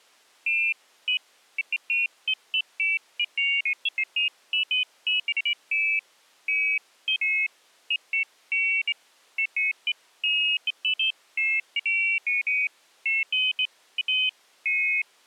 Pairs of high tones at irregular times. There is no code.